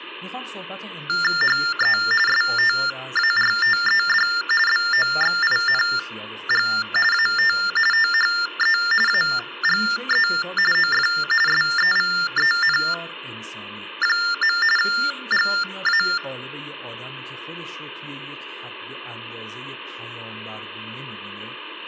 TTY/TDD text telephone tones (45.45 baud Baudot), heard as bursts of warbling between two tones, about 400 Hz shift, 1600 Hz centre, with speech in Persian. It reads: HE STARTED BOXING AT THE AGE OF SEVEN. GA